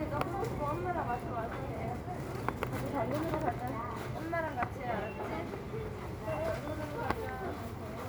The noise of a crowd indoors. There is no code.